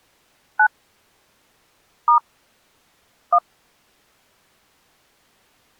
DTMF, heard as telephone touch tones, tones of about 90 ms. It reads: 9 * 1